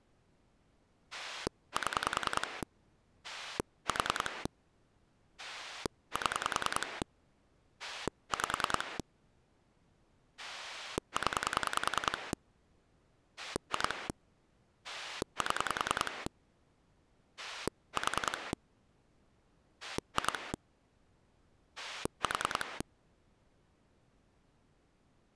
Pulse dialling, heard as a rotary dial, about 10 pulses a second. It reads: 7 4 7 5 0 2 7 4 2 4